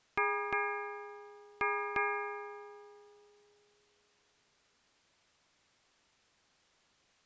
Ship's bell, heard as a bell. 4. Four half-hours of the watch have passed.